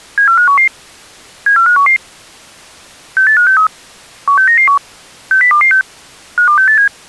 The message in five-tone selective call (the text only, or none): 74511 74511 68563 16991 60226 52687